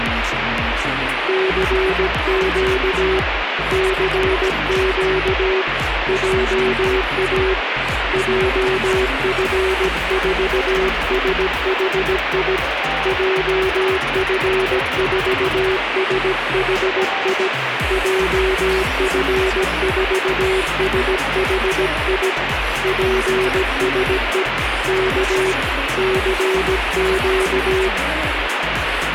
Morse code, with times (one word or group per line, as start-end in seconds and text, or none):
1.3-3.2 CQ
3.7-5.6 CQ
6.1-7.5 JA
8.1-12.6 JF4SHI
13.1-17.5 JF4SHI
17.9-22.3 JF4SHI
22.8-24.4 PSE
24.9-25.5 K
26.0-27.9 CQ